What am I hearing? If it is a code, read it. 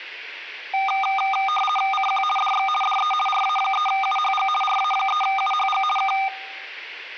RTTY (50 baud, 450 Hz shift), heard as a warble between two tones, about 1000 Hz centre. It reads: CQ DX DE RA3UHG RA3UHG K